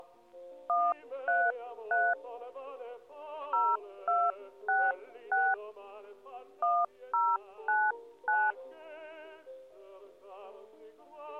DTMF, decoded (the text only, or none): 133 0266 1099